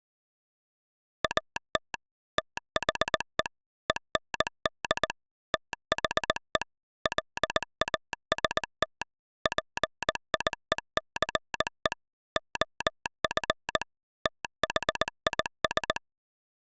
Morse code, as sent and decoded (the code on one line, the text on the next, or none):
.- - / - .... . / . -. -.. / - .... . / .-.. .- ... - / .--. .. . -.-. . / --- ..-. / - .... .. ...
AT THE END THE LAST PIECE OF THIS